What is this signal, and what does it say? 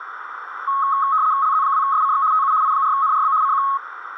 RTTY (75 baud, 170 Hz shift), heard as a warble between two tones, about 1180 Hz centre, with radio static and a narrow filter. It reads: LZ2SCX TU I4NRB CQ